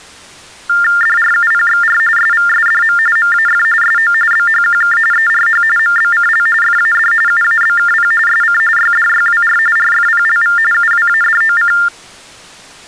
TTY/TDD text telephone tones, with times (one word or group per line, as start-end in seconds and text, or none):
1.0-2.0 DRUPXR
2.2-3.0 SVSDM
3.2-3.6 MAF
3.8-4.1 SO
4.3-5.0 BHQK
5.1-5.6 ERH
5.8-6.5 MBCL
6.6-7.1 FAD
7.3-8.1 UABKP
8.3-8.6 SC
8.8-9.6 YDYWR
9.8-10.6 RFPLV
10.7-11.7 UWADOC